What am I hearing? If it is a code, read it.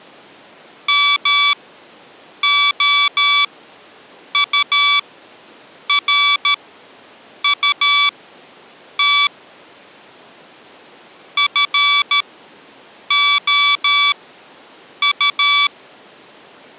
Morse code, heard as electronic beeps, machine-sent, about 13 wpm, spaced as for 7 wpm, 1150 Hz. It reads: MOURUT FOU